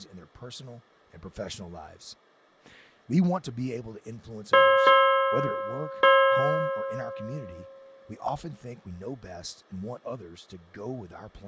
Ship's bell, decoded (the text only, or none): 3